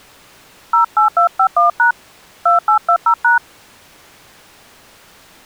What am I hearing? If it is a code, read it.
DTMF, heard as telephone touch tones, dialled by hand, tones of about 100 ms. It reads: 08251# 2820#